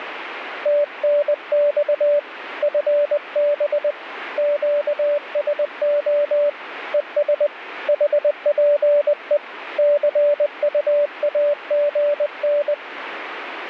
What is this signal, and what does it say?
Morse code, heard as a keyed tone, hand-sent with a paddle, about 20 wpm, 580 Hz, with radio static. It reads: TNX FB QSO ES HPE CUAGN